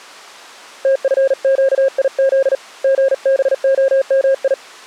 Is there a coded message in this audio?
Yes: Morse code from 0.8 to 4.6 s, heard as a keyed tone, hand-sent with a paddle, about 39 wpm, 540 Hz. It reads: TFQIZ GBOMI